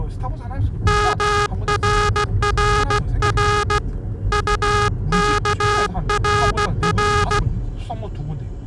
Morse code, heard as a buzzer, hand-sent with a paddle, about 16 wpm, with the noise inside a car. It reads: MRRR UKRR